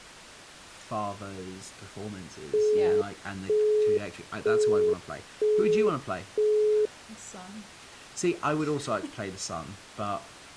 Telephone call progress tone (single-tone plan, as in Europe, Japan and elsewhere), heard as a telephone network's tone, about 420 Hz, 0.48 s on and 0.48 s off, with speech in English. Busy tone.